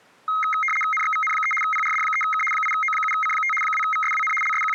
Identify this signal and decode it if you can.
RTTY (75 baud, 850 Hz shift), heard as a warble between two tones, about 1700 Hz centre. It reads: NXVN3 PRD3K 8O7C5 2VSWN …